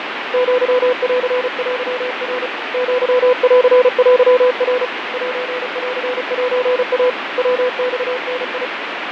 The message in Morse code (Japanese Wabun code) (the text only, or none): アンテナ アンテナ センセイ ヤマダ